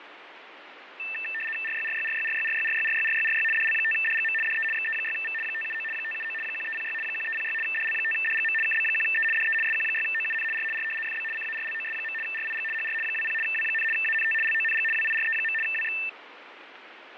RTTY (75 baud, 850 Hz shift), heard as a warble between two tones, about 2200 Hz centre, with radio static and fading. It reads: RYRYRYRYRYRYRYRYRY DL5DGM DE XE6V 579 579 1306 1306 DL5DGM KB1E DE SQ6OUN R R FB CARLOS. RIG HR 20 W, ANT LONG WIRE. WX